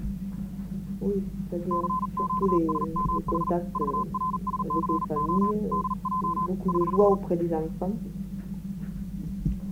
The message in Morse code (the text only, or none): CQSMH VRSCO DJ <HH>